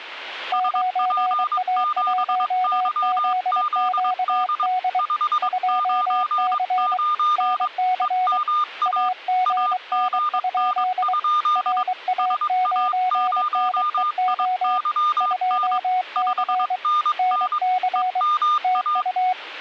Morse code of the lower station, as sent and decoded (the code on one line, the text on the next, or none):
----. .- .---- --.. --.- -.. / ..--- -.-. / -. -.-. / .- --. -. ..--.. / .-. .- ----. -. . --- / ..--- -.-. / -. -.-. / - ..-
9A1ZQD 2C NC AGN? RA9NEO 2C NC TU